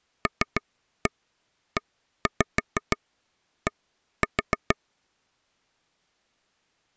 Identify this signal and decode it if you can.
Tap code, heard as taps on a table, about 6 knocks a second. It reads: LED